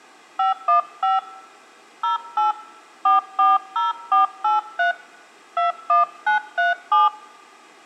DTMF, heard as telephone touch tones, dialled by hand, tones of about 150 ms, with room echo. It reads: 515 08 440483 21937